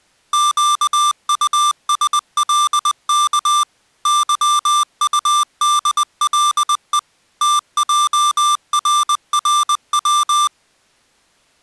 Morse code, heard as electronic beeps, machine-sent, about 20 wpm, 1180 Hz. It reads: QUSLK YUDLE TJRRW